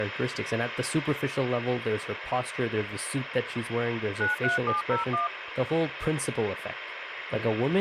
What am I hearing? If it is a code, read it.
DTMF, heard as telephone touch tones, dialled by machine, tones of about 140 ms, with radio hiss and speech in English. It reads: 93701